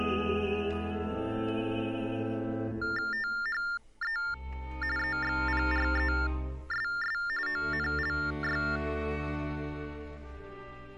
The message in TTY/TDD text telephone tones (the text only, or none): THE EXPRESS ONLY